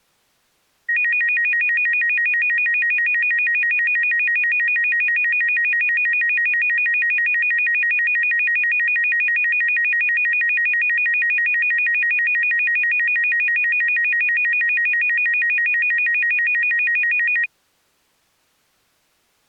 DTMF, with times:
none

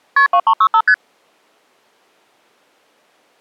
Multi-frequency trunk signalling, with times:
0.2-0.3 KP
0.3-0.8 2365
0.9-0.9 ST

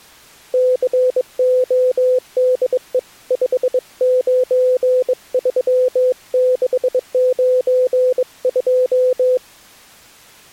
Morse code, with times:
0.5-3.0 CODE
3.3-9.4 593692

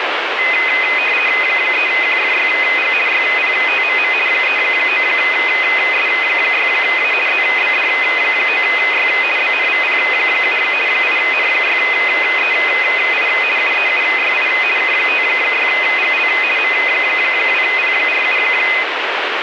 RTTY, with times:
1.4-2.9 3QFYG
3.1-4.1 YPTMM
4.3-7.1 39S6A
7.3-9.1 ZBD9Y
9.4-10.6 BNVP7
10.9-13.3 8N6EI
13.6-14.5 UEUYI
14.8-16.3 K56GL
16.6-18.4 M2P47

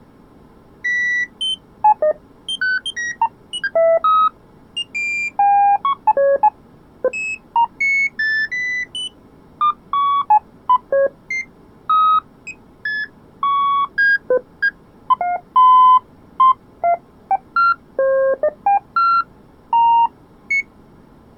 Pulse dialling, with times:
none

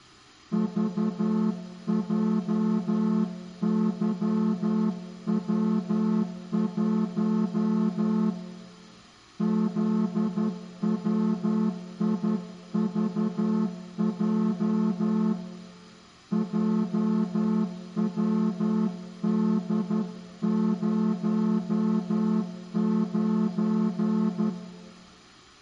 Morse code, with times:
0.5-8.3 VJYW1
9.4-15.3 ZWIVJ
16.3-24.5 JWD09

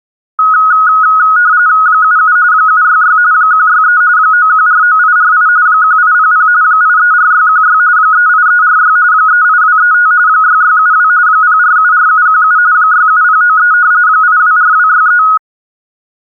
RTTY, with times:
1.9-2.4 77
2.5-3.2 766
3.3-4.0 163
4.2-5.5 9149848
5.7-6.5 1800
6.6-7.8 834616
8.0-9.0 38346
9.1-10.1 38235
10.3-11.1 6672
11.3-12.6 0474717
12.7-13.7 67093
14.1-15.2 824263

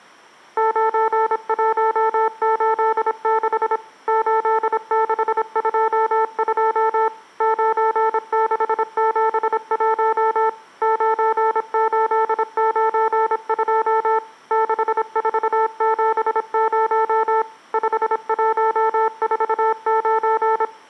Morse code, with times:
0.6-3.8 9186
4.1-7.1 8622
7.4-10.5 9671
10.8-14.2 9892
14.5-17.4 6470
17.7-20.6 5149

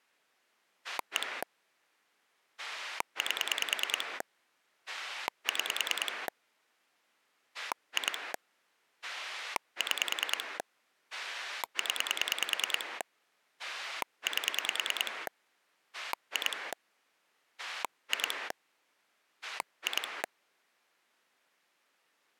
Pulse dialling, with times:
0.8-1.4 1
2.6-4.2 8
4.9-6.3 6
7.5-8.3 2
9.0-10.6 6
11.1-13.0 0
13.6-15.3 8
15.9-16.7 2
17.6-18.5 2
19.4-20.2 2

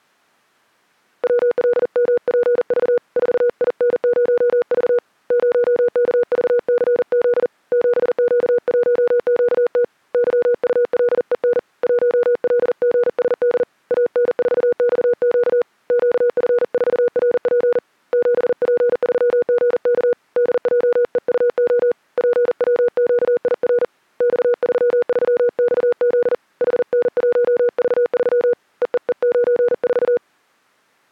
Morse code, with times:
1.2-3.0 WLMPV
3.2-5.0 4IN0V
5.3-7.5 0KVCZ
7.7-9.8 7Q1QT
10.1-11.6 YULEN
11.8-13.6 1LGSD
13.9-15.6 AN4XQ
15.9-17.8 QF4RP
18.1-20.1 7P3GK
20.4-21.9 DJEUO
22.2-23.8 PWQIR
24.2-26.3 X33XZ
26.6-28.5 HN1V3
28.8-30.2 EEE94

